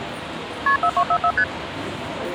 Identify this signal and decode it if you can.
Multi-frequency trunk signalling (R1, as on North American trunks), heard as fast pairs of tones, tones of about 70 ms, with phone line noise and the noise of a subway station. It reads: KP 4244 ST